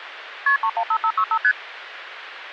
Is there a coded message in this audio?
Yes: multi-frequency trunk signalling (R1, as on North American trunks) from 0.5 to 1.5 s, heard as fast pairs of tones, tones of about 70 ms, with phone line noise. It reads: KP 315565 ST